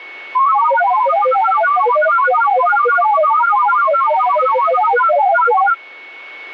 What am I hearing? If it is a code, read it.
Multi-tone FSK (Olivia or MFSK type), about 1000 Hz wide, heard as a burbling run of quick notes, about 31.25 baud, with a steady whistle near 2210 Hz.